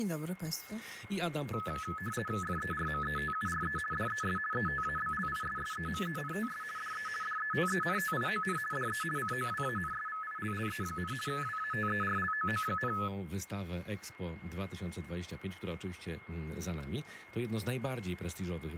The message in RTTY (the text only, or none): FERMETURE DES ETABLISSEMENTS DE DETENTION DE COWANSVILLE, WATERLOO,